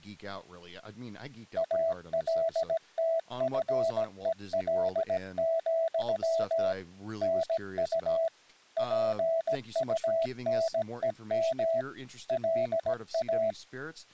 Morse code, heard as a keyed tone, machine-sent, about 17 wpm, 660 Hz, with speech in English. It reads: ALTFEL, NU PUNEM LA